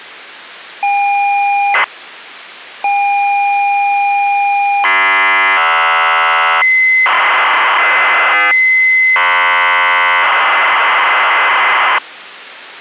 ZX Spectrum tape loading, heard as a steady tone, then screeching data.